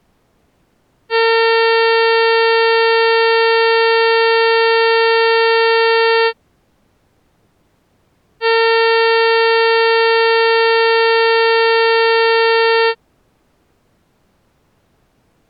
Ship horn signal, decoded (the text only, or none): 2 long